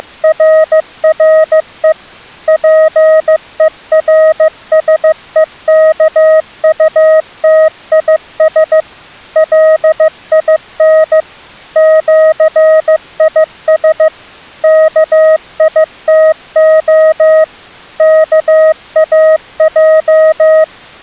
Morse code (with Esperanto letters), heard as a keyed tone, machine-sent, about 15 wpm, 630 Hz. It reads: … PERSEKUTIS LIN ĜIS KITO KAJ